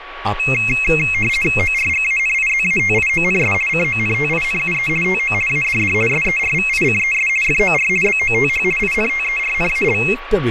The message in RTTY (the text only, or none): ORGANIZATIONS CONTINUE TO ADD SERVICES FOR BOTH INTERNAL